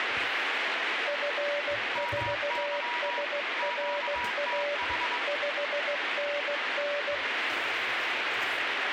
Morse code, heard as two keyed tones, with radio static and kitchen noise. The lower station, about 16 wpm, 580 Hz: F4SRA 5NN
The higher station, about 22 wpm, 960 Hz: MY QTH